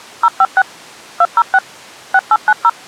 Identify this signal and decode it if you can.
DTMF, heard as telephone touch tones, dialled by machine, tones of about 50 ms. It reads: 056 206 6890